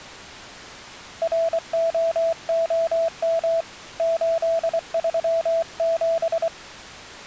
Morse code, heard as a keyed tone, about 24 wpm, 660 Hz. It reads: ROOM 837